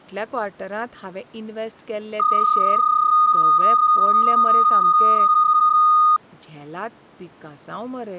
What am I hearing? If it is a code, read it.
PSK31 (31.25 baud), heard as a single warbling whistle, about 1230 Hz, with speech in Goan Konkani.